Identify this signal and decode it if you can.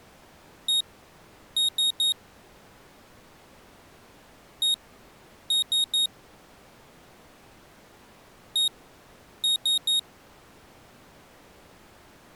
Beep code, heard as a piezo beeper, played three times, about 3750 Hz. 1-3.